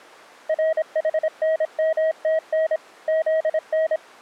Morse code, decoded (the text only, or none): RHNMTN ZN